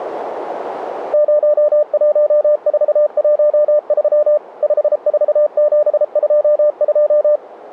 Morse code, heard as a keyed tone, machine-sent, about 33 wpm, 600 Hz. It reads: 01413 54722